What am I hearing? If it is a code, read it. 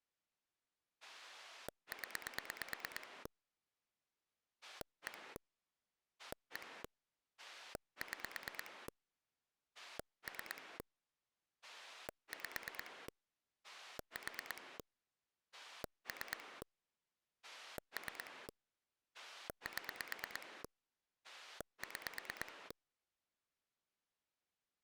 Pulse dialling, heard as a rotary dial, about 9 pulses a second. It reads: 0 1 1 6 3 5 4 3 3 7 6